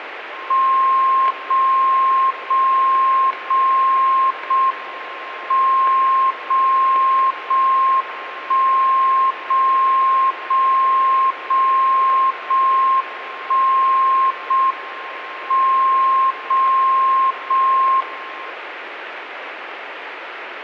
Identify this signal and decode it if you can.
Radio time signal (JJY), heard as a tone whose level steps once a second, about 1060 Hz, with radio static. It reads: 0 0 0 0 M 0 0 1 0 0 0 0 1 0 M 0 0 1